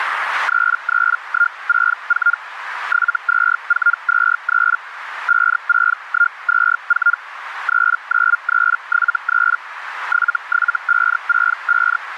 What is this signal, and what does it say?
Hellschreiber (Feld-Hell, 122.5 baud), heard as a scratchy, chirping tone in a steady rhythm, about 1410 Hz, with radio static and a narrow filter. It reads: 33164 72423 56124 39373 77565